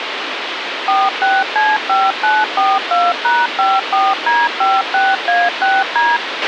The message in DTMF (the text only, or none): 46C5942#54D56A6D